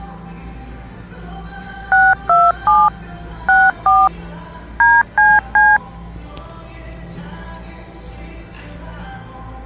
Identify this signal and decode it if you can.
DTMF, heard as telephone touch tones, dialled by machine, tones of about 220 ms, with the noise of a cafe. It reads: 627 64 DCC